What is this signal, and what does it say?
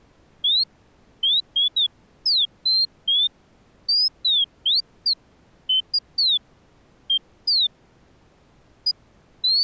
Bird-like chirps. There is no code.